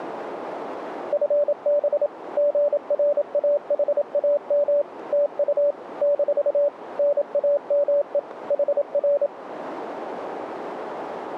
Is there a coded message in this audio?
Yes: Morse code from 1.1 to 9.3 s, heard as a keyed tone, machine-sent, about 27 wpm, 580 Hz, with radio static. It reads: FB GRAHAM TU - NAME HR